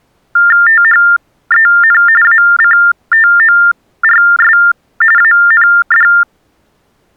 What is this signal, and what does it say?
TTY/TDD text telephone tones (45.45 baud Baudot), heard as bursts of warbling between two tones, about 400 Hz shift, 1600 Hz centre. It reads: THEN ACTORS AND